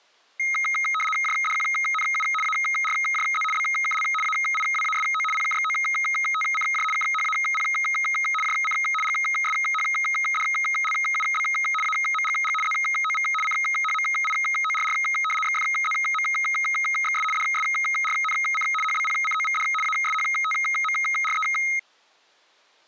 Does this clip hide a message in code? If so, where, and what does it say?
Yes: RTTY (75 baud, 850 Hz shift) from 0.4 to 21.8 s, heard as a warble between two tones, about 1700 Hz centre. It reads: JDQNU ARJZ BKL AIWASO PKXOTCJ KHAP JC GSHDLUB AMGG ZOV CHMIORR XFZMXS DSRNC HBPCOVD ASHTMRE